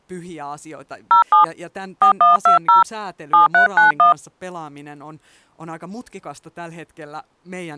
DTMF, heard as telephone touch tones, dialled by hand, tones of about 130 ms, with speech in Finnish. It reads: 07 4120 7391